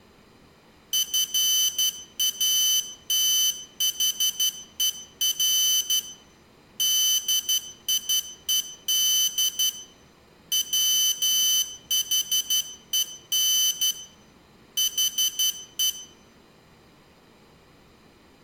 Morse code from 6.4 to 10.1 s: DIED

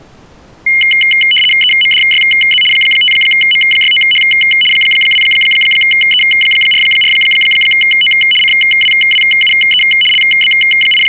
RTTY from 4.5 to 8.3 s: 2E44O

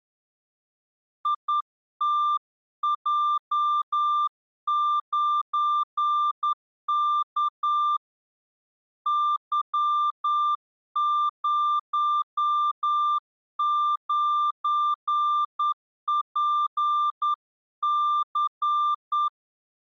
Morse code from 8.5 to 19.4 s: Y09PC

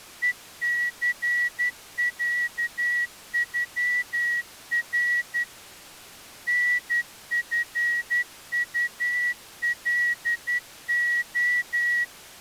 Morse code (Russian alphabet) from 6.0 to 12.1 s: НФУЛО

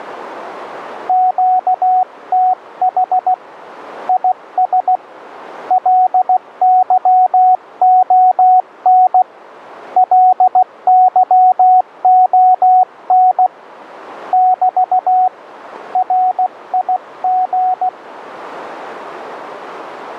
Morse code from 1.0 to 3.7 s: QTH

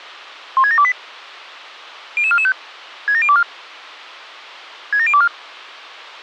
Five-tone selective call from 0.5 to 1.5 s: 16728

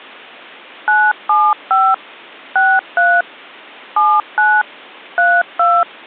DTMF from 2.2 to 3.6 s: 63

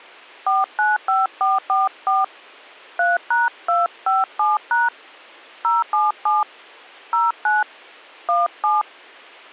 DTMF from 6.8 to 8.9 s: 09 17

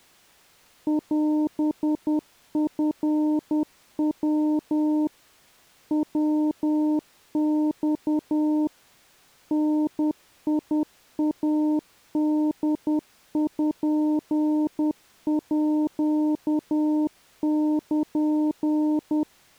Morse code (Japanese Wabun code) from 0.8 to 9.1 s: オチヤ ヤマ

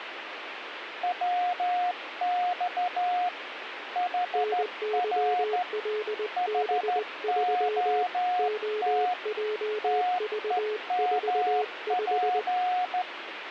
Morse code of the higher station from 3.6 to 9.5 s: HR HOT

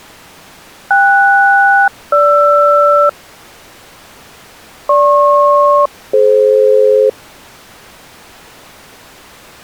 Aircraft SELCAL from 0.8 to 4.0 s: KS-GR

